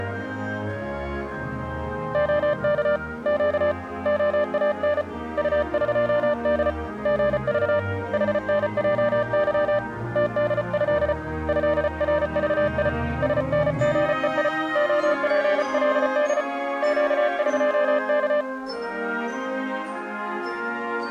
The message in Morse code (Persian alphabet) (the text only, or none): عک گ عان طقد ژذ حنجظ تدض ضرذی سنژهی عپلد گقک